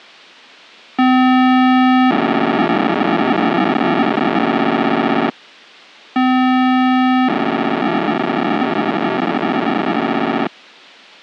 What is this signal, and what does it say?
POCSAG pager data (512 baud), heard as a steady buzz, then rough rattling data.